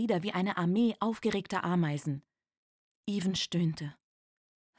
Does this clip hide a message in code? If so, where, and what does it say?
No.